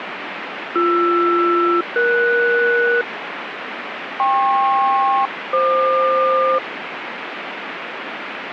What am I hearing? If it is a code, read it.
Aircraft SELCAL, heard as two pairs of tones, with radio static. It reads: BR-ES KP-FQ